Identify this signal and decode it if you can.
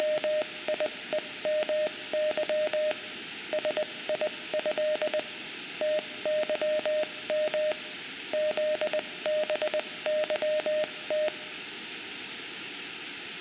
Morse code (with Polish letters), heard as a keyed tone, machine-sent, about 20 wpm, spaced as for 17 wpm, 610 Hz, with room echo. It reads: … SIĘ TYM ZBYT